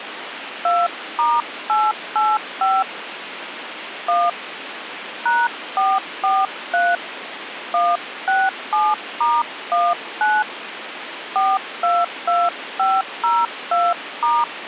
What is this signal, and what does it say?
DTMF, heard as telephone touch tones, dialled by hand, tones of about 220 ms, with phone line noise. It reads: 2*885 1 #443 167*19 422502*